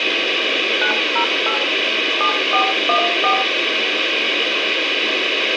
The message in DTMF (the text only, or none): 908 7414